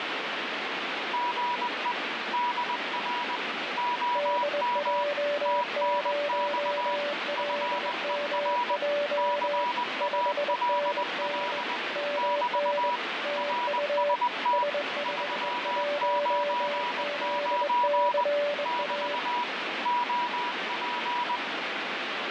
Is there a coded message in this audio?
Yes: Morse code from 1.1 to 21.4 s, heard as two keyed tones, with heavy radio static. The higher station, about 20 wpm, 970 Hz: GE DR OM TNX FER CALL <BT> RST 399 <BT> OP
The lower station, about 21 wpm, 580 Hz: DJ0LMJ 5NN MN TU S51ZCA